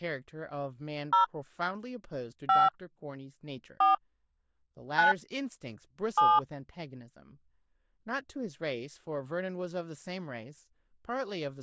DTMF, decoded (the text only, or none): 0 5 4 9 7